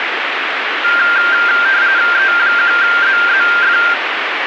RTTY (45.45 baud, 170 Hz shift), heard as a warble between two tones, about 1490 Hz centre, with radio static. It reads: E1ZZF